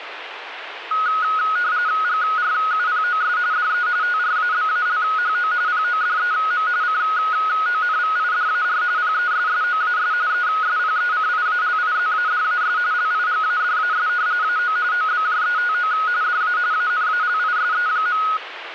RTTY (45.45 baud, 170 Hz shift), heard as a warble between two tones, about 1360 Hz centre, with radio static. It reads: GRUPOS DE TRABALHO PODEM CONVIDAR PESSOAS ESPECIALIZADAS LIGADAS AO OBJETO DA ANALISE.